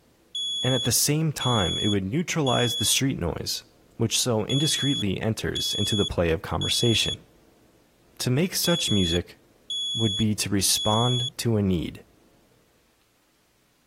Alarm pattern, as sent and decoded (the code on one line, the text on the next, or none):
3 beeps and a pause
temporal three